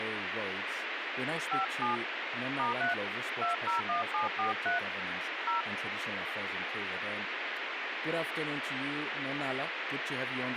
DTMF, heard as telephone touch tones, dialled by hand, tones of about 140 ms, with radio hiss and speech in English. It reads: 57 *3 201743 0